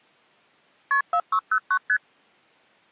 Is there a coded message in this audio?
Yes: multi-frequency trunk signalling (R1, as on North American trunks) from 0.9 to 2.0 s, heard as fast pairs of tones, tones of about 70 ms. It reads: KP 4609 ST